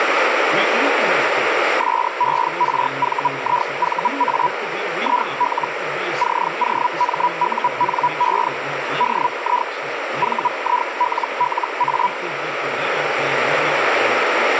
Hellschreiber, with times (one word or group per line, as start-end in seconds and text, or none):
1.8-4.5 SERVIVA
5.0-5.7 IL
6.2-8.5 COMUNE
9.0-9.7 DI
10.2-12.1 VILLA